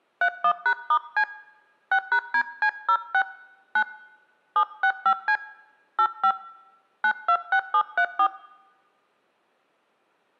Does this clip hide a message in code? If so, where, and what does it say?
Yes: DTMF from 0.2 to 8.3 s, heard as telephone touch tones, dialled by hand, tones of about 70 ms. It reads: 31#*C 6#DC06 9 765C 85 926734